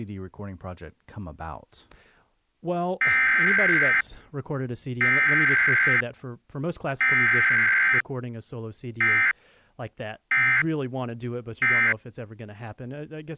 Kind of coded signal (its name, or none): Emergency Alert System (SAME) tones